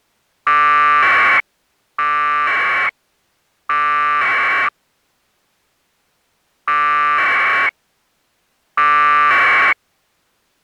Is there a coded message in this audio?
Yes: packet radio (AX.25, as in APRS), 1200 baud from 0.5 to 9.7 s, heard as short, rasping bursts.